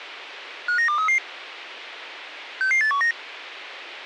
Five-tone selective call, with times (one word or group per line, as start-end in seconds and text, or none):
0.7-1.2 59233
2.6-3.1 66819